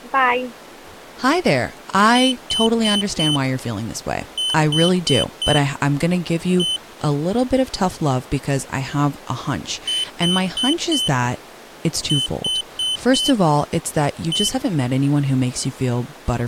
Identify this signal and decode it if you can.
Beep code, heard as a piezo beeper, played twice, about 3050 Hz, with speech in English. 4-4-1. In Phoenix BIOS tables: serial port failure.